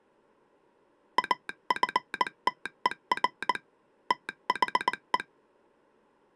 Morse code, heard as a telegraph sounder, hand-sent with a paddle, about 19 wpm. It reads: AFTER THE